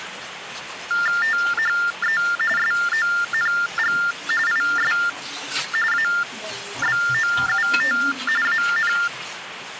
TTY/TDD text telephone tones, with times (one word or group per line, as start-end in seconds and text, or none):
1.2-2.2 THE
2.6-4.0 SONG
4.5-4.9 IS
5.9-8.0 ABOUT
8.5-8.9 AN